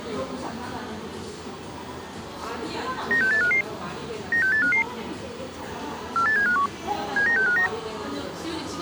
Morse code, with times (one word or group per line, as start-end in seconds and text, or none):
none